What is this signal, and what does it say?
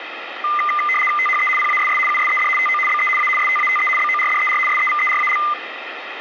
RTTY (75 baud, 850 Hz shift), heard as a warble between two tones, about 1600 Hz centre, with radio static. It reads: THE PASS USED TO BE A STATE BORDER SEVERAL